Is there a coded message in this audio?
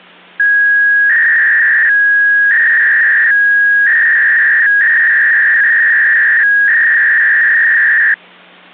Yes: 300-baud modem data (V.21 tones) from 0.4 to 8.1 s, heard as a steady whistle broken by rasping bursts, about 300 baud, 200 Hz shift.